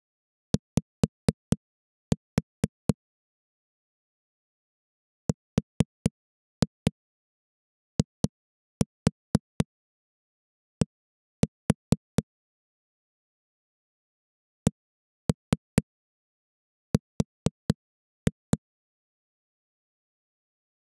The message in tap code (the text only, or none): Y RID CR